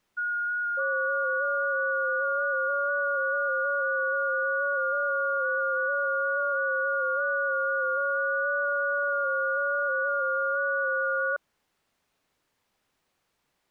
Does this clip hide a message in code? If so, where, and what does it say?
Yes: FT8 (several signals at once) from 0.2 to 11.4 s, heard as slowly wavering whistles, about 6.25 baud.